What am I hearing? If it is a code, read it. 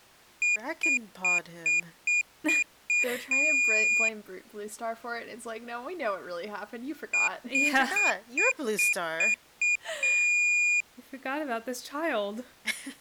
Beep code, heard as a piezo beeper, played twice, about 2450 Hz, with speech in English. 7 short, 1 long.